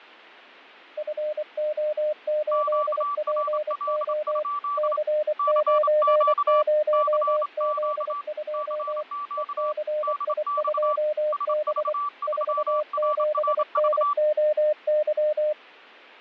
Morse code, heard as two keyed tones, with fading. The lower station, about 24 wpm, 610 Hz: FO8PO C90Z2 ECI2B 47NOY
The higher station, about 27 wpm, 1160 Hz: QRL? CQ CQ CQ DX SV3RRV